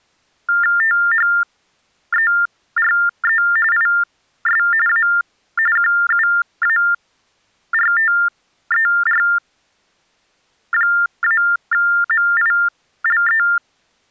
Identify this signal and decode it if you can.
TTY/TDD text telephone tones (45.45 baud Baudot), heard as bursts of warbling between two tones, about 400 Hz shift, 1600 Hz centre. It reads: THERE IS A QUARTER-MILE